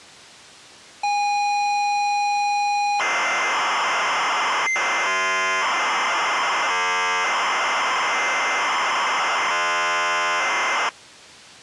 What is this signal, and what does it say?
ZX Spectrum tape loading, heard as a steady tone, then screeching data.